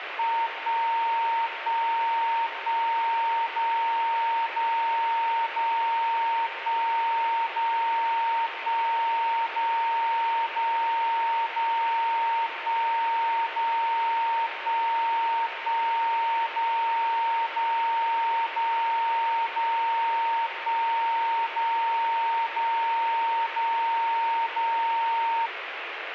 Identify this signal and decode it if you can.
Radio time signal (DCF77), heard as a tone whose level steps once a second, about 920 Hz, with radio static. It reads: 1 1 1 0 0 0 1 0 1 0 0 0 1 0 1 1 0 0 0 0 1 0 0 0 0